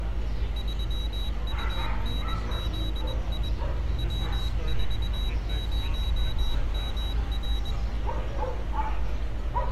Morse code, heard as a high beeper, hand-sent with a paddle, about 21 wpm, 3850 Hz, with street noise. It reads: 3UNZI W40MR